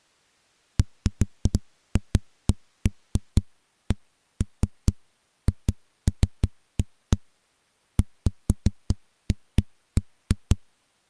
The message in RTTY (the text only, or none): none